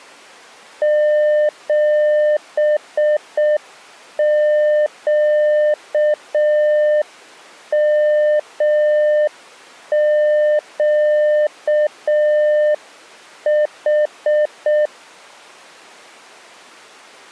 Morse code, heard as a keyed tone, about 6 wpm, 600 Hz. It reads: 7QMQH